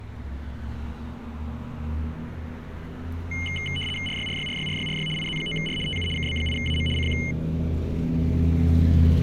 RTTY (75 baud, 850 Hz shift), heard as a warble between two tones, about 2550 Hz centre, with street noise. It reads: RYRYRYRYRY IZ9R TU KB8AM CQ